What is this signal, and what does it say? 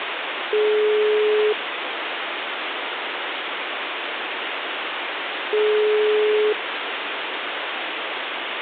Telephone call progress tone (single-tone plan, as in most of Europe), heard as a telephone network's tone, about 420 Hz, 1 s on and 4 s off, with phone line noise. Ringback tone.